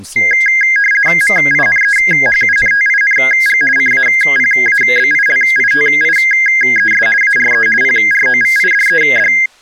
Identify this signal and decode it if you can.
RTTY (50 baud, 450 Hz shift), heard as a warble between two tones, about 1850 Hz centre, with speech in English. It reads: MINEHUNTING CAPABILITIES ARE PROVIDED